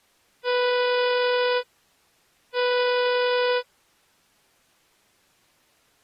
Ship horn signal, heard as a ship's horn, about 490 Hz. 2 short. At sea: I am altering course to port.